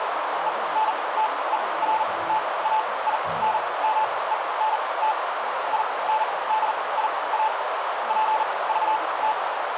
Morse code, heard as a keyed tone, machine-sent, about 40 wpm, spaced as for 23 wpm, 870 Hz, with heavy radio static, a narrow filter and the noise of a restroom. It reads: ENTERTAINMENT INDIA PVT